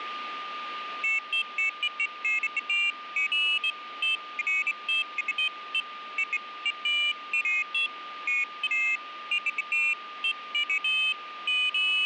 Pairs of high tones at irregular times, with radio static and a steady whistle near 1210 Hz. There is no code.